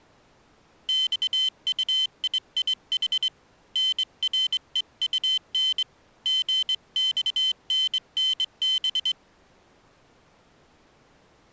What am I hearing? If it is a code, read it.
Morse code (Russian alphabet), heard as a high beeper, hand-sent with a straight key, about 22 wpm, 3100 Hz. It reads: ЬУИИХ НРЕУН ГЬННБ